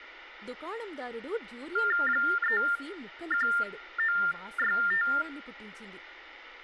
TTY/TDD text telephone tones (45.45 baud Baudot), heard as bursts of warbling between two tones, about 400 Hz shift, 1600 Hz centre, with phone line noise, room echo and speech in Telugu. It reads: 31965